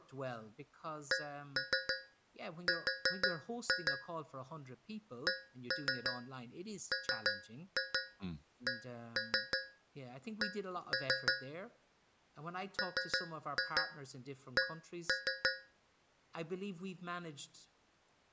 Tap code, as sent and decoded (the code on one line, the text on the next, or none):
1-3 4-2 / 1-3 3-2 1-3 1-3 / 3-2 1-3
CR CMCC MC